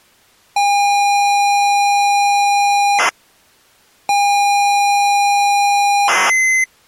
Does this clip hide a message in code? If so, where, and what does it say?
Yes: ZX Spectrum tape loading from 0.6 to 6.6 s, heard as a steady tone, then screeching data.